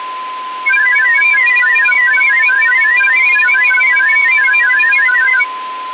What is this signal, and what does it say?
Multi-tone FSK (Olivia or MFSK type), about 1000 Hz wide, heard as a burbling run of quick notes, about 31.25 baud, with a steady whistle near 1020 Hz.